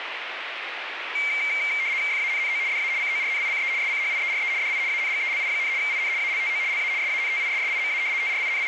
RTTY (75 baud, 170 Hz shift), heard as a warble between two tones, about 2200 Hz centre, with radio static. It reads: FANNO DA CORNICE SCHIERE DI ANGELI, IN ALTO LA SANTISSIMA …